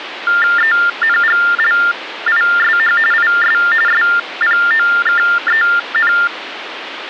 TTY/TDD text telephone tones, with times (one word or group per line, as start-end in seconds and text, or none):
0.6-3.0 ENGLISH
3.1-3.6 IS
3.9-6.1 SPOKEN